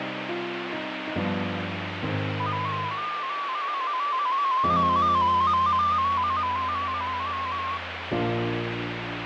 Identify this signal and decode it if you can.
Multi-tone FSK (Olivia or MFSK type), about 250 Hz wide, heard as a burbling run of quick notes, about 15.625 baud, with radio static and fading.